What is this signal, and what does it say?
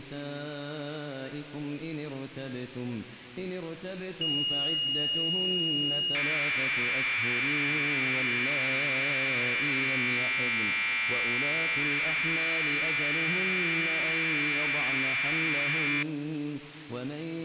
Commodore tape loading (standard loader), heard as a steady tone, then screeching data.